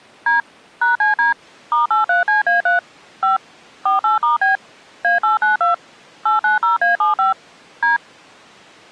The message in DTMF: D #CD *83CA3 5 48*B A892 890A75 D

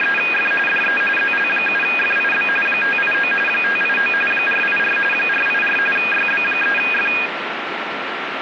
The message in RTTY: … DE ZL7FIB 589 589 484 484 YB3F

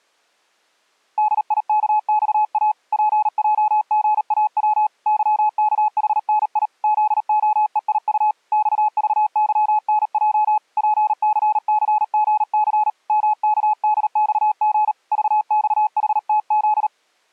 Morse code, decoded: DIKXA PJGAW YKHNI ZOEIU XVYNJ PCCGC MKDXG VXHTZ

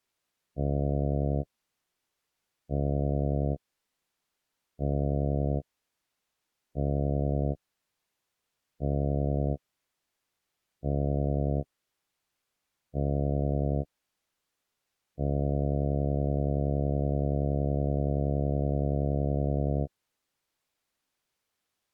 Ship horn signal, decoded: 7 short, 1 long

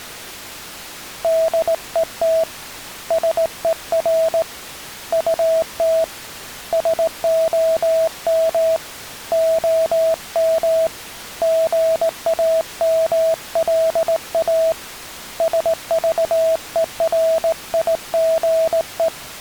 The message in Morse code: DET SER UT SOM OM GAMLA SVERIGE

